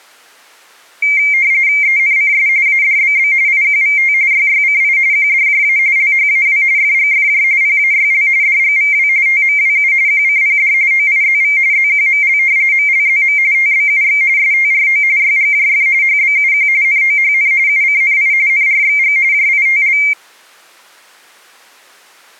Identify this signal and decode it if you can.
RTTY (45.45 baud, 170 Hz shift), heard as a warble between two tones, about 2200 Hz centre. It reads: ENCS ADBB IQVT YYCI QDJA LHAW FGFJ PAYL DGVW TMWU QCPD OIZV ZQML MLZM TBUX STRO YGJF HBUQ NOHN UCNI NRXG JITL